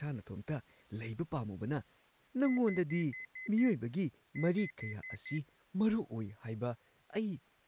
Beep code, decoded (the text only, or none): 6-5